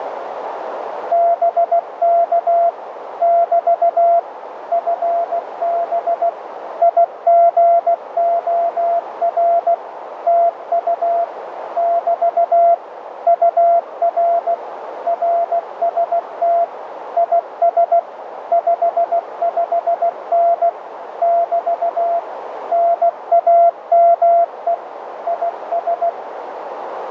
Morse code, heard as a keyed tone, machine-sent, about 16 wpm, 680 Hz, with radio static and a narrow filter. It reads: BK <BT> FB IGOR TU <BT> UR RST IS 55N <BT> NAME IS